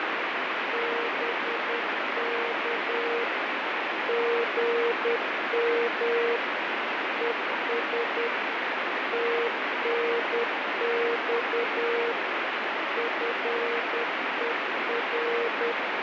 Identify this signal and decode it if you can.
Morse code, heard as a keyed tone, machine-sent, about 10 wpm, 470 Hz, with heavy radio static and fading. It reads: BK GM ES TNX FER